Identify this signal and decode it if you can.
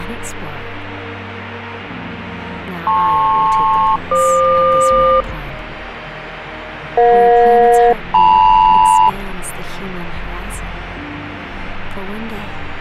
Aircraft SELCAL, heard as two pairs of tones, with radio static. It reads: LP-FQ EJ-LM